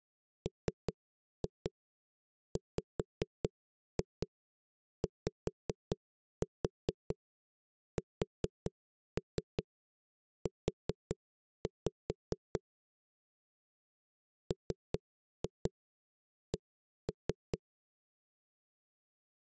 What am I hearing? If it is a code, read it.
Tap code, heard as knocks on a wall, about 4 knocks a second. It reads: MWYSU MC